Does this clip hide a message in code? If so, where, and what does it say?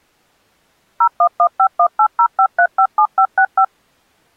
Yes: DTMF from 1.0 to 3.6 s, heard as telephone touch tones, dialled by machine, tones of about 80 ms. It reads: 01151805357565